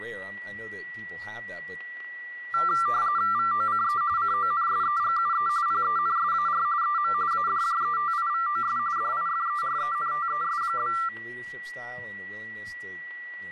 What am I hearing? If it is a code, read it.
RTTY (45.45 baud, 170 Hz shift), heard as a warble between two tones, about 1270 Hz centre, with static crashes, a steady whistle near 1940 Hz and speech in English. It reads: VOCE CONSEGUE PENSAR EM ADJETIVOS DIFERENTES?